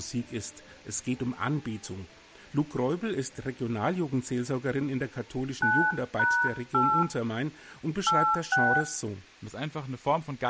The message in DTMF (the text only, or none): 9#8 86